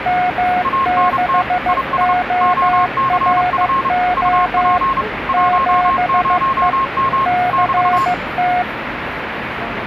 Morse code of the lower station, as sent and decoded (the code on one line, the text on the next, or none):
-- -.... --- .-. --- / --... . / -.-. -
M6ORO 7E CT